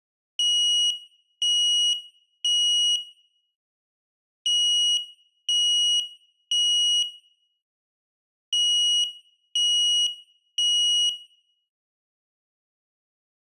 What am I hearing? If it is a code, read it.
Alarm pattern, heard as an alarm's beeps, played three times, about 2900 Hz, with room echo. Temporal three. Smoke or fire, evacuate.